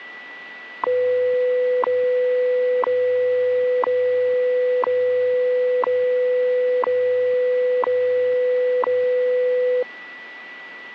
Radio time signal (WWV, Colorado), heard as ticks, one a second, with a steady whistle near 1960 Hz.